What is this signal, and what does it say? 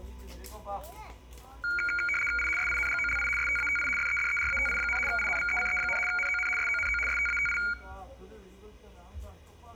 RTTY (75 baud, 850 Hz shift), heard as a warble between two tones, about 1850 Hz centre, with room echo and the noise of a park. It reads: I SINGOLI STATI FEDERATI, INVECE, NON SONO STATI